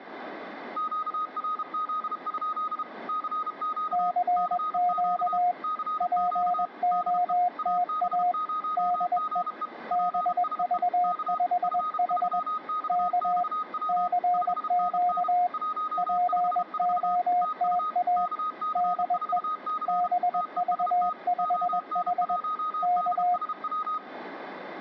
Morse code, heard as two keyed tones, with room echo. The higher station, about 32 wpm, 1250 Hz: QRZ? CQ CQ CQ DE AB0GE PSE K F3XXW 5NN 154 TU KC4C TEST ON1DSW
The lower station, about 21 wpm, 720 Hz: CQ POTA DE BV5H K CQ POTA DE BV5H K